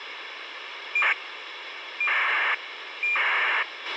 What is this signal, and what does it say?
ACARS aircraft data, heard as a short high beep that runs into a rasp, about 2400 baud, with radio hiss and a squelch burst at the end.